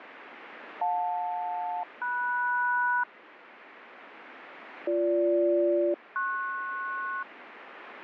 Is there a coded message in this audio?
Yes: aircraft SELCAL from 0.8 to 7.2 s, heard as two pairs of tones, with radio static. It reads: JL-MS BG-PS